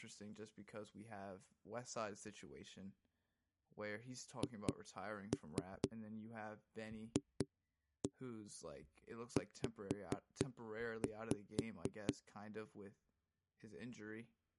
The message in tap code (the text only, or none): HFZ